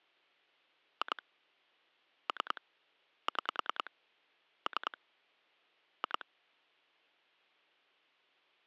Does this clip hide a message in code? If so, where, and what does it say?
Yes: pulse dialling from 1.0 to 6.2 s, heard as clicks on a phone line, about 10 pulses a second. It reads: 2 3 6 3 2